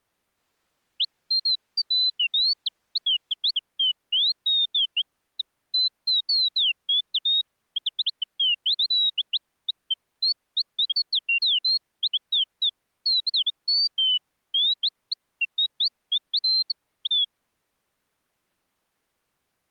Bird-like chirps. There is no code.